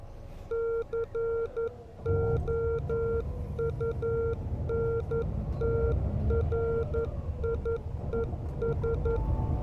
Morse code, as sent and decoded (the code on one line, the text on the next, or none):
-.-. --- ..- -. - .-. .. . ...
COUNTRIES